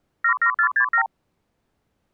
Multi-frequency trunk signalling (R2, with the far end's replies), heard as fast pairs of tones, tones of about 90 ms. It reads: 77467